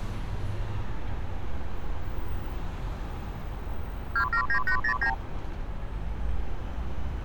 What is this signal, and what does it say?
Multi-frequency trunk signalling (R2, with the far end's replies), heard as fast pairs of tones, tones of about 90 ms, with street noise. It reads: 279809